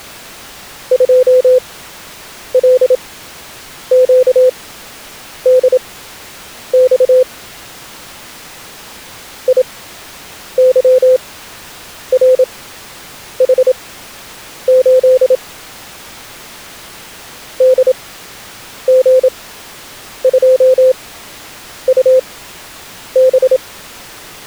Morse code, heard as a keyed tone, machine-sent, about 27 wpm, spaced as for 8 wpm, 510 Hz. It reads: 2LQDX IYRH8 DG2UB